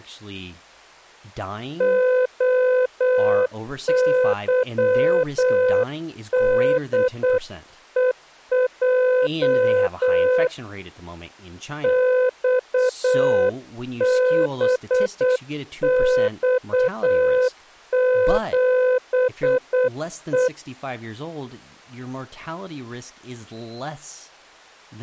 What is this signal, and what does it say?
Morse code, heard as a keyed tone, hand-sent with a paddle, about 8 wpm, 510 Hz, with speech in English. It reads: OYDEJ XBX7E